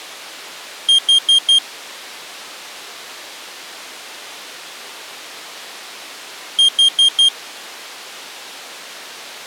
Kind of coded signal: alarm pattern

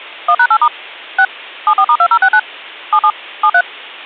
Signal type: DTMF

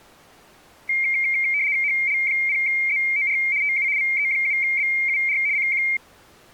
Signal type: RTTY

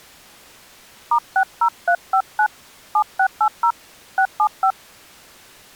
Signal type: DTMF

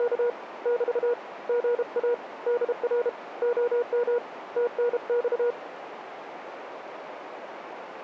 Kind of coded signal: Morse code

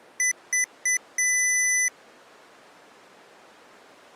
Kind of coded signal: beep code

